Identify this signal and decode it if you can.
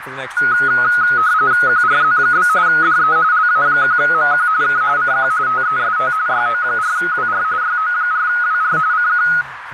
RTTY (45.45 baud, 170 Hz shift), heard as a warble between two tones, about 1360 Hz centre, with radio static, a narrow filter and speech in English. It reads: QRZ? DE LA1MQ K CQ TEST YO4WR YO4WR CQ